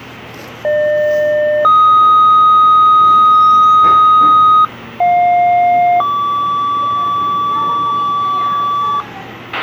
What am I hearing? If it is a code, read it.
Two-tone page, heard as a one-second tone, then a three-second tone, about 600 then 1250 Hz, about 710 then 1150 Hz, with a squelch burst at the end and the noise of a cafe.